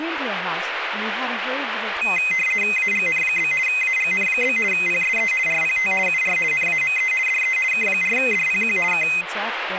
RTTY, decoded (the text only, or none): AGN? AGN? PSE RPT UR NAME DE K4DPQ K